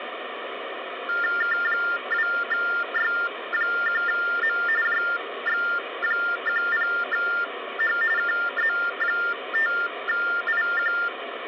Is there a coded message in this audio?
Yes: TTY/TDD text telephone tones (45.45 baud Baudot) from 1.1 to 11.1 s, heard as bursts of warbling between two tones, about 400 Hz shift, 1600 Hz centre, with phone line noise. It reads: K2Y1M JX10H KZ5IQ